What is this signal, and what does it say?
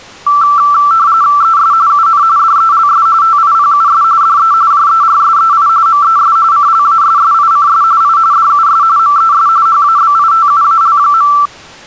RTTY (45.45 baud, 170 Hz shift), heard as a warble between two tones, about 1250 Hz centre. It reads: ES UN DELS TIPUS DE JERSEI MES CLASSICS I DUS MES HABITUAL.